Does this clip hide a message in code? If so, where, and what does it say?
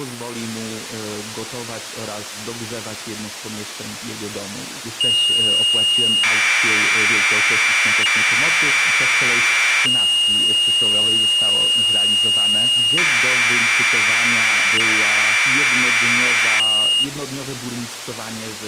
Yes: Commodore tape loading (standard loader) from 5.0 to 17.0 s, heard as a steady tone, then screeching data.